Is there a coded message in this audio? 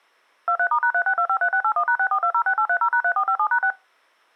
Yes: DTMF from 0.5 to 3.7 s, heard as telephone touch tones, dialled by machine, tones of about 80 ms. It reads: 23*#36253681#64206830#3457#6